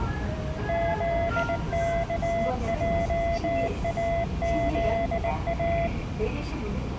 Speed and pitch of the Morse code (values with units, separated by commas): 19 wpm, 680 Hz